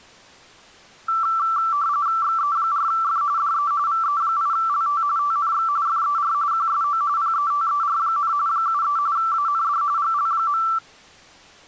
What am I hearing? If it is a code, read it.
RTTY (45.45 baud, 170 Hz shift), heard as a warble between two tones, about 1250 Hz centre. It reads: XE4F DE VE8LT TNX FER QSO PETER, 73 AND GL.